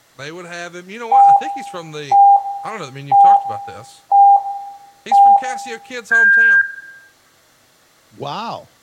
Radio time signal (five pips and a higher one, as on Chinese radio), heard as pips, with room echo and speech in English.